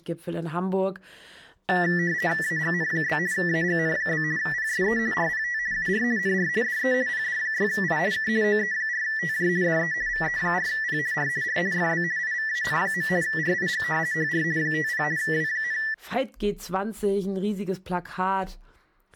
RTTY (50 baud, 170 Hz shift), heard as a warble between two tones, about 1850 Hz centre, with speech in German. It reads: AGN? AGN? PSE RPT UR NR DE PD6I K OE4TJ DE VE4P R R FB IVAN. RIG HR 50 W,